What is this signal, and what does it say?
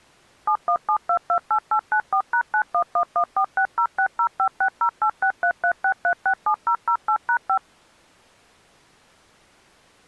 DTMF, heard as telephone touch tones, dialled by machine, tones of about 80 ms. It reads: 717228894#91114606056086336367008#5